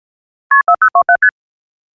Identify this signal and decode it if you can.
Multi-frequency trunk signalling (R1, as on North American trunks), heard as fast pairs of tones, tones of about 70 ms. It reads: KP 4027 ST